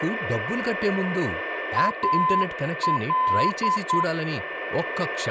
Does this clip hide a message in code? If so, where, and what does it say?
Yes: Morse code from 1.7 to 4.1 s, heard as a keyed tone, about 9 wpm, 1020 Hz, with radio static, a steady whistle near 1780 Hz and speech in Telugu. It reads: AL